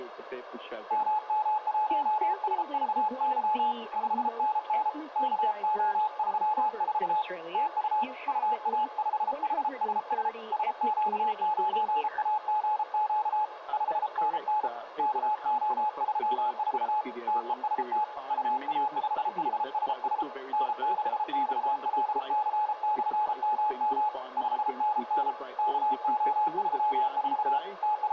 Morse code, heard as a keyed tone, hand-sent with a paddle, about 33 wpm, 850 Hz, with room echo. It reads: MM1SVY 5NN KO34 TU UA5HSS SQ9AGQ 5NN KO34 TEST UA5HSS N6XLC/MM 5NN KO34 …